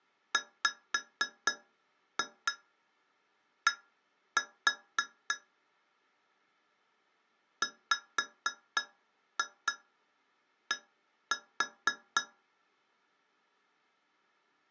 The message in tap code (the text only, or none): WD WD